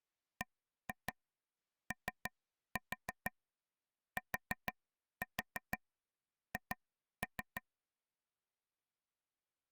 Tap code, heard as taps on a table, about 6 knocks a second. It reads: BOTH